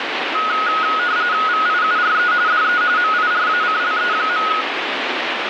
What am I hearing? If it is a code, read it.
RTTY (45.45 baud, 170 Hz shift), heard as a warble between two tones, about 1360 Hz centre, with radio static. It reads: VIURE DE MIRACLE.